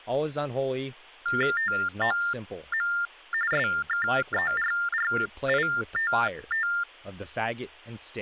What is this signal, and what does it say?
TTY/TDD text telephone tones (45.45 baud Baudot), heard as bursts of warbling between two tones, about 400 Hz shift, 1600 Hz centre, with speech in English. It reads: TOM SKERRITT